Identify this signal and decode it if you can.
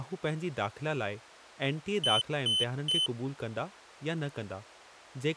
Beep code, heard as a piezo beeper, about 3050 Hz, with speech in Sindhi. 3 short. In AMI BIOS tables: failure in the first 64 KB of memory; in Dell tables: chipset error.